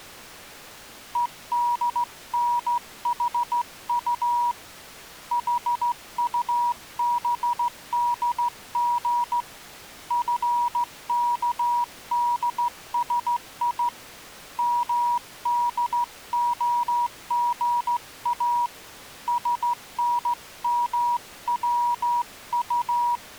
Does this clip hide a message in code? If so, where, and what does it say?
Yes: Morse code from 1.1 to 23.2 s, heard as a keyed tone, hand-sent with a straight key, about 15 wpm, 960 Hz. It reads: EDNHU HUBDG FKDSI MDOGA SNMWU